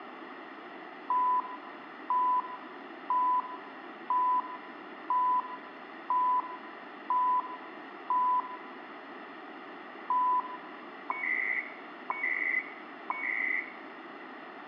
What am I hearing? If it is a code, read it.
Radio time signal (CHU, Canada), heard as beeps and data bursts, one a second, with radio static and room echo.